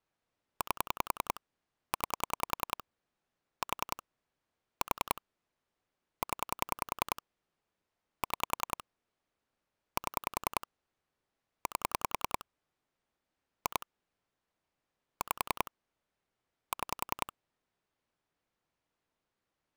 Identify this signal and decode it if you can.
Pulse dialling, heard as clicks on a phone line, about 10 pulses a second. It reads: 8 9 4 4 0 6 7 8 2 5 6